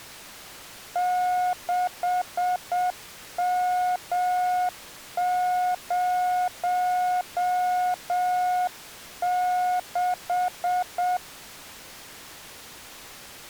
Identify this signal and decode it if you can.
Morse code, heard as a keyed tone, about 7 wpm, 720 Hz. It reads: 6M06